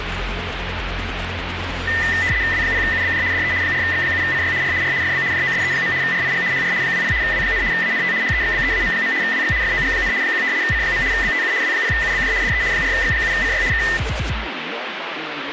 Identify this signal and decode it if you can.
RTTY (75 baud, 170 Hz shift), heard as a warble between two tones, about 1900 Hz centre, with radio static. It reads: W0UBJ DE 4X7CY R R FB JOSE. RIG HR 20 W, ANT HEXBEAM. WX FOG, 1 C. BTU W0UBJ DE 4X7CY K